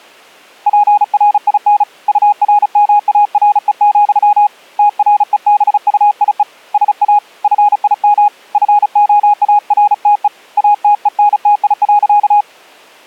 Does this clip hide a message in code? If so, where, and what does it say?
Yes: Morse code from 0.6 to 12.5 s, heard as a keyed tone, hand-sent with a paddle, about 35 wpm, 830 Hz. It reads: PRIN URMARE, TREBUIE SA FIM FOARTE ATENTI.